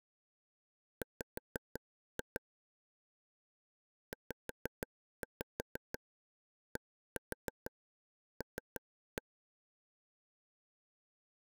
Tap code, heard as taps on a table, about 6 knocks a second. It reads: W ZDL